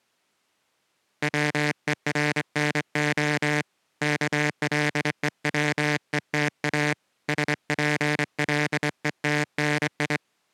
Morse code (Russian alphabet), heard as a buzzer, hand-sent with a straight key, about 24 wpm. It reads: ВЕРНО КЛЕВЕТА СПЛЕТНИ